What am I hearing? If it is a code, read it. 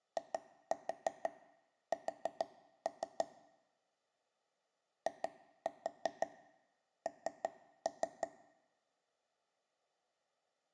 Tap code, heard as taps on a table, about 6 knocks a second, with room echo. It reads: IS IN